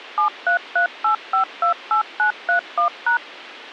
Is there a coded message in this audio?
Yes: DTMF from 0.2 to 3.2 s, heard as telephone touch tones, dialled by machine, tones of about 110 ms. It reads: 7338528931#